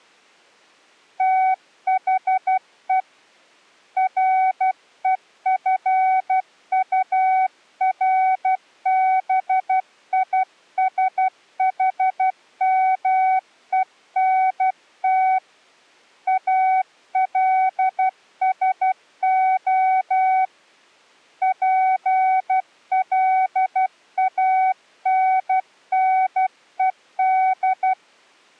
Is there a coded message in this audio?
Yes: Morse code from 1.1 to 28.0 s, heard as a keyed tone, hand-sent with a paddle, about 12 wpm, 750 Hz. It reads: THE REFURBISHMENT ALSO PLANNED